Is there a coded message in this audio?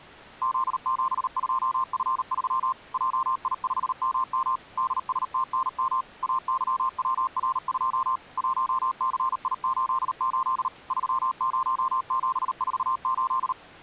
Yes: Morse code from 0.4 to 13.6 s, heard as a keyed tone, machine-sent, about 38 wpm, 1050 Hz. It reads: Z72F3 JI5MM DSTNM AYWR2 1CI88 30748